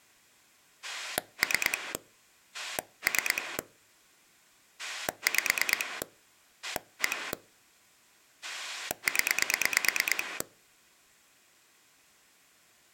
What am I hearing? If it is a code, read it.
Pulse dialling, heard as a rotary dial, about 9 pulses a second. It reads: 3 3 5 1 0